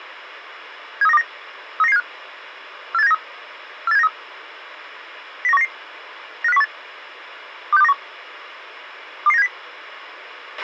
Five-tone selective call (EEA), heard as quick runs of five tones, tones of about 40 ms, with a squelch burst at the end. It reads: 73929 39975 48793 48793 09199 95018 26291 22970